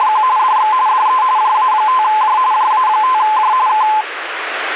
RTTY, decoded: … DX DE JA5J JA5J K

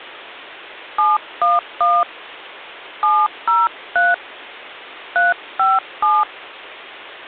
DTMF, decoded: 711 703 357

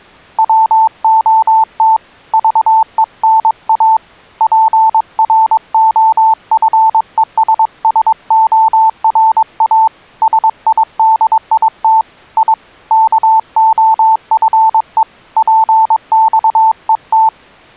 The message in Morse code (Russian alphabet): ВОТ ЖЕНА ПРОФЕССОРА СИДИТ И КОФЕ ПЬЕТ

